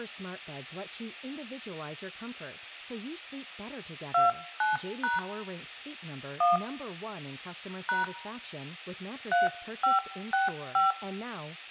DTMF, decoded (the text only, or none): 29# 1 # 3565